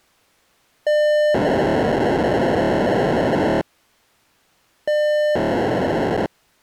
POCSAG pager data (1200 baud), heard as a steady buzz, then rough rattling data.